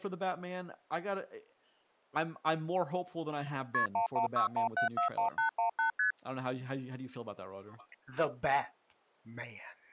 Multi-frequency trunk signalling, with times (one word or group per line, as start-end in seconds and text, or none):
3.7-3.9 KP
3.9-5.9 1161741818
6.0-6.1 ST